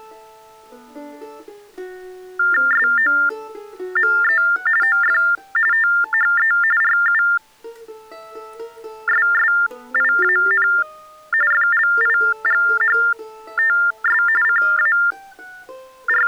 TTY/TDD text telephone tones (45.45 baud Baudot), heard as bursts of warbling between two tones, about 400 Hz shift, 1600 Hz centre. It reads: SOME OF THE RUSSIAN FLIGHTS …